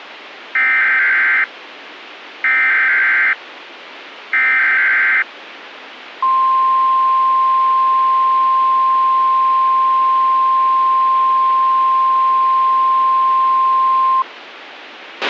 Emergency Alert System (SAME) tones (header bursts, then the 1050 Hz attention tone), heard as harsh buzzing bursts, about 520.83 baud, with radio hiss and a squelch burst at the end.